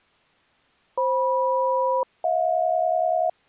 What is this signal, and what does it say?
Aircraft SELCAL, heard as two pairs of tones. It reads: FM-HJ